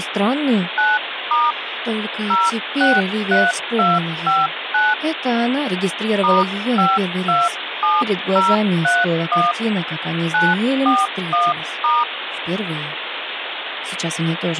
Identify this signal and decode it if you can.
DTMF, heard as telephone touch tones, dialled by hand, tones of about 200 ms, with phone line noise. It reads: 9* 063259 *527031 941*